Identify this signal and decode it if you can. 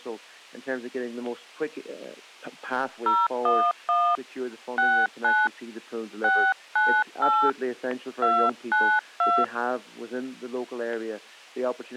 DTMF, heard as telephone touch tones, dialled by hand, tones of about 250 ms. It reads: 011 69 698 292